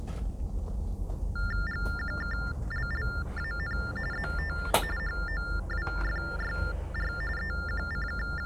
TTY/TDD text telephone tones (45.45 baud Baudot), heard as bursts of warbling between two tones, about 400 Hz shift, 1600 Hz centre, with the noise inside a bus. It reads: GQKLLAN ZT HOWFYR …